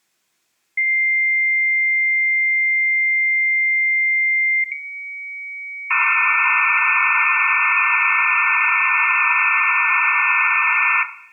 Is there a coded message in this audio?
Yes: dial-up modem handshake (low-speed, two carriers) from 0.8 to 11.0 s, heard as two whistles, then hiss, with room echo.